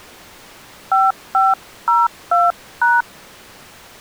DTMF, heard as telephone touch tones, dialled by hand, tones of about 190 ms. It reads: 5502#